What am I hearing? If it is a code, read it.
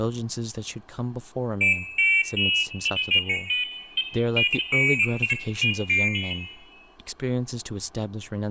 Pairs of high tones at irregular times, with room echo and speech in English. There is no code.